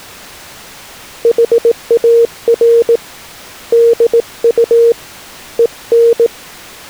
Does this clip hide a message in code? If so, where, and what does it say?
Yes: Morse code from 1.2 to 6.3 s, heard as a keyed tone, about 18 wpm, 470 Hz. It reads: HAR DU EN